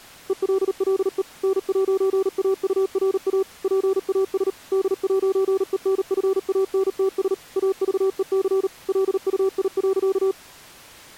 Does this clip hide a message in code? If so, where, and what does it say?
Yes: Morse code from 0.2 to 10.4 s, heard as a keyed tone, machine-sent, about 38 wpm, 380 Hz. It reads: ELLE N'AURA PAS D'ENFANTS AVEC LUI.